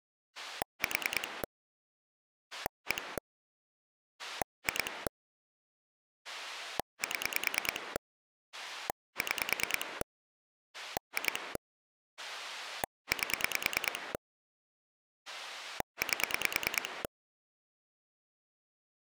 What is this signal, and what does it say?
Pulse dialling, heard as a rotary dial, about 9 pulses a second. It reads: 4 1 2 7 6 2 8 8